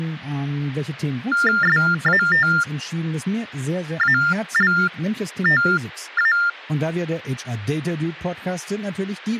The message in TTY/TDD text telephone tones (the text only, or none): SATALTA